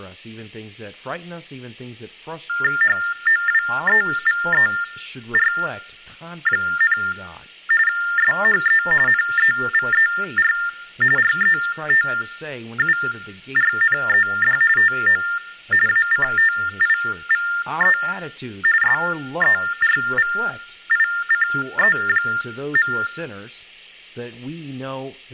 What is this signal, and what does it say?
TTY/TDD text telephone tones (45.45 baud Baudot), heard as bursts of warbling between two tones, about 400 Hz shift, 1600 Hz centre, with hum and speech in English. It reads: HOWEVER, SHE NEVER RETURNED TO ACTIVE SERVICE.